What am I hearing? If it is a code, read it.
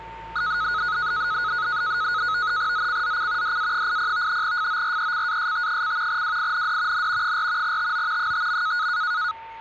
NAVTEX (SITOR-B), 100 baud, 170 Hz shift, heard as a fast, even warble, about 1360 Hz centre, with a steady whistle near 900 Hz and street noise. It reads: ZCZC DA80 FORECAST: WIND N 4 TO 5.